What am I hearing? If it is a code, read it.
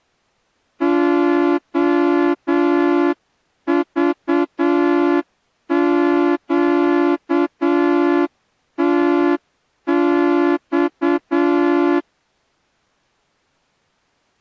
Morse code, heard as a horn, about 8 wpm. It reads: OVQTX